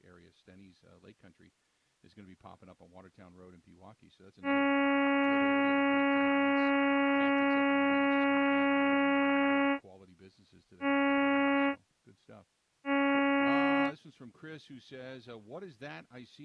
Ship horn signal, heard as a ship's horn, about 280 Hz, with speech in English. 1 long, 2 short. At sea: a vessel in fog that is sailing, fishing, towing or hampered.